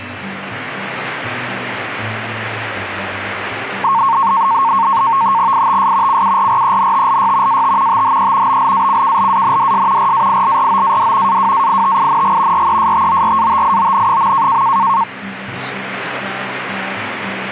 NAVTEX (SITOR-B), 100 baud, 170 Hz shift, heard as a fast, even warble, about 1000 Hz centre. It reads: ITS CURRENTLY AT THE BLACKLANDS RAILROAD AWAITING RESTORATION.